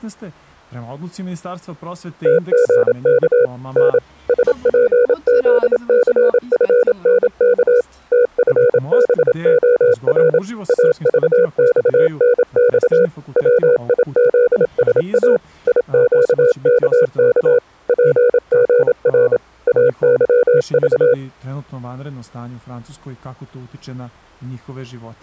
Morse code, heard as a keyed tone, machine-sent, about 27 wpm, 490 Hz. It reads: TGK N SPZCFNK TFBOR AVXNX WIZSA IQKK PGR AYV